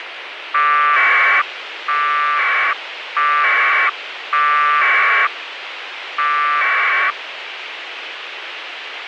Packet radio (AX.25, as in APRS), 1200 baud, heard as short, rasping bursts, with radio hiss.